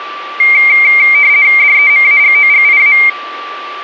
RTTY (50 baud, 170 Hz shift), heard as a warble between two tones, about 2200 Hz centre, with a steady whistle near 1170 Hz. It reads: DEMAGOGIA